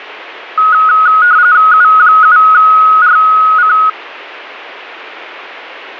RTTY (45.45 baud, 170 Hz shift), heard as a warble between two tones, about 1360 Hz centre. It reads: U7RC